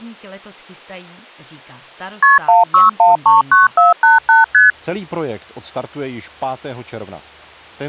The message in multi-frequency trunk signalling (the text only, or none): KP 16139488 ST